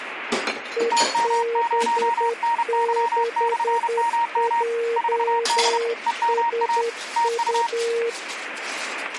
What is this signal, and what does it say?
Morse code, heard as two keyed tones, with radio static and kitchen noise. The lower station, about 10 wpm, 460 Hz: EB6JSU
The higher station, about 31 wpm, 930 Hz: TM0NY/MM 4D EMA TU